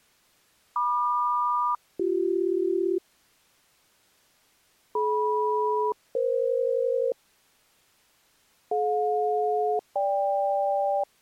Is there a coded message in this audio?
Yes: aircraft SELCAL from 0.8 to 11.0 s, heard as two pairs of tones. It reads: MQ-BC DM-EF DJ-GK